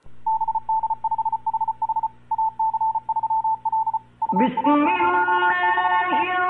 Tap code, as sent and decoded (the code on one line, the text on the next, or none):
none